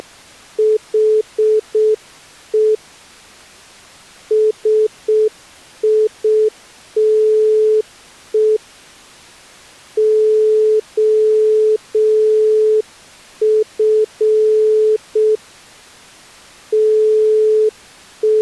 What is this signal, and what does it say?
Morse code, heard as a keyed tone, hand-sent with a straight key, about 6 wpm, 430 Hz. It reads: … SITE OF …